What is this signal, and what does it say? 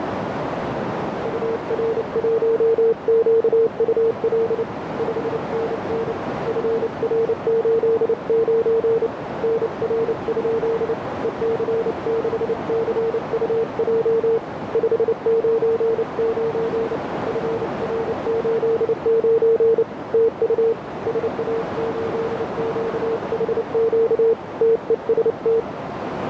Morse code, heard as a keyed tone, hand-sent with a paddle, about 29 wpm, 450 Hz, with heavy radio static and a narrow filter. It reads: UR1QUL 5NN FR89 NR? EC6CUJ 599 FR89 TU SA8QHQ TEST